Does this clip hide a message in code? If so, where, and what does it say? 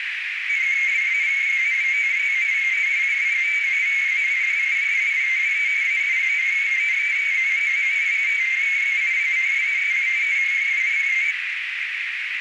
Yes: multi-tone FSK (Olivia or MFSK type), about 250 Hz wide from 0.5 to 11.4 s, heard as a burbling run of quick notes, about 31.25 baud, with heavy radio static and a narrow filter.